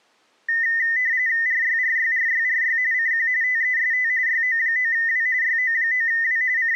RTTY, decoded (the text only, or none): RYRYRYRY CQ TEST YO9W YO9W …